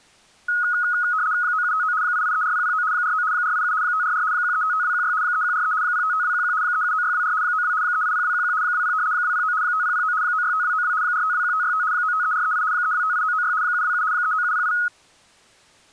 RTTY (75 baud, 170 Hz shift), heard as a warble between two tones, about 1360 Hz centre. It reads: 9759 8834009 49 487 544 1355216 3143 055211 379624 92 380211 20 209 5009 965292 4521565 953438 3258996 727 39708